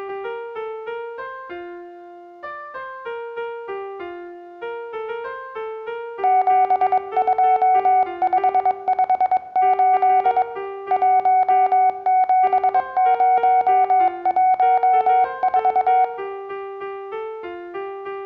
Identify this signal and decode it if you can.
Morse code, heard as a keyed tone, hand-sent with a paddle, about 22 wpm, 740 Hz, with room echo. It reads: 72558 17014